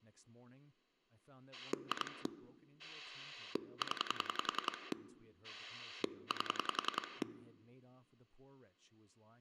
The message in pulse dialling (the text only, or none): 2 0 8